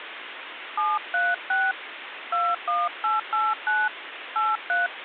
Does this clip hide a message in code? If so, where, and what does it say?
Yes: DTMF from 0.8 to 4.9 s, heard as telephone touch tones, dialled by hand, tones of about 200 ms, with phone line noise. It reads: 736 21889 83